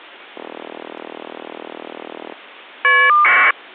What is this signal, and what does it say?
Caller ID data burst, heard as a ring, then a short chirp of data, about 1200 baud.